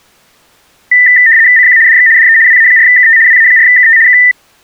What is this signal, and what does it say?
RTTY (75 baud, 170 Hz shift), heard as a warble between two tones, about 1900 Hz centre. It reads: CQ DX DE WA4KT WA4KT K